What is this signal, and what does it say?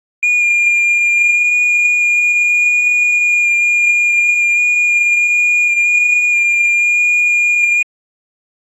FT8 (one signal), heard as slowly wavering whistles, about 6.25 baud.